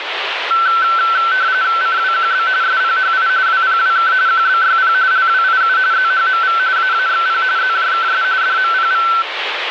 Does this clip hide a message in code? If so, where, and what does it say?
Yes: RTTY (45.45 baud, 170 Hz shift) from 0.5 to 9.2 s, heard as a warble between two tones, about 1430 Hz centre, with radio static. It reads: CWQB SPHI WPWK QBYP LWIU ZHMV AAXP ZJKS DMPV